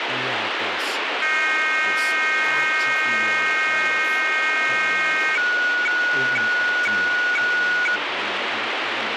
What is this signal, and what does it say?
Weather fax (radiofax), 120 lines a minute, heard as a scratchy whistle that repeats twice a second, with radio static and speech in English.